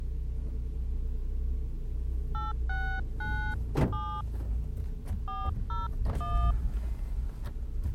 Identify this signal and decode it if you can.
DTMF, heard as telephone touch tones, dialled by hand, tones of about 270 ms, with the noise inside a car. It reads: 8697 401